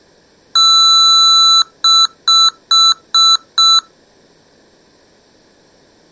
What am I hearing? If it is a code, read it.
Beep code, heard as beeps from a small speaker, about 1330 Hz. 1 long, 5 short.